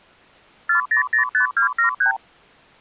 Multi-frequency trunk signalling (R2, with the far end's replies), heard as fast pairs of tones, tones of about 110 ms. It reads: 4005273